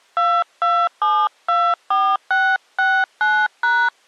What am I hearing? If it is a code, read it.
DTMF, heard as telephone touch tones, dialled by hand, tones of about 260 ms. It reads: 22724669#